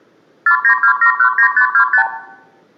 Multi-frequency trunk signalling (R2, with the far end's replies), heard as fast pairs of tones, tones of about 90 ms, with room echo. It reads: 492719525